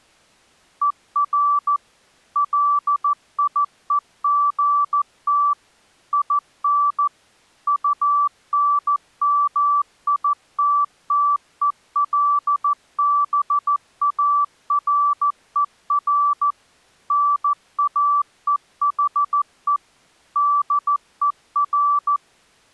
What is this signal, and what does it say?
Morse code, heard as a keyed tone, machine-sent, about 14 wpm, 1160 Hz. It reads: ER LIEGT IN UNMITTELBARER NAEHE DER